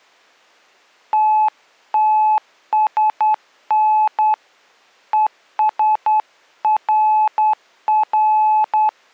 Morse code, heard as a keyed tone, hand-sent with a straight key, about 10 wpm, 860 Hz. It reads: TTSN ESRR